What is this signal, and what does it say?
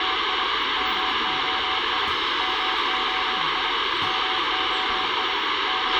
Morse code, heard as a keyed tone, machine-sent, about 25 wpm, 760 Hz, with radio hiss, a squelch burst at the end, room echo and the noise inside a bus. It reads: … MOI MOI MOI …